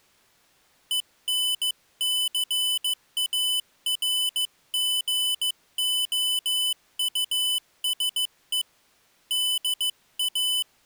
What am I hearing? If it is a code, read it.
Morse code, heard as a high beeper, hand-sent with a paddle, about 15 wpm, 3000 Hz. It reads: ENCARGOUSE DA